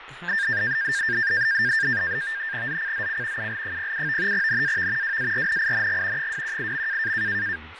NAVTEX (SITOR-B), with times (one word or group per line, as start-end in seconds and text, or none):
2.7-3.5 ZCZC
3.4-4.3 UL07
4.3-5.2 NAV
5.0-6.3 WARNING
6.2-7.1 218.